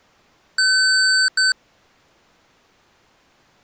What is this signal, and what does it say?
Beep code, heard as beeps from a small speaker, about 1550 Hz. 1 long, 1 short. In IBM BIOS tables: system board problem.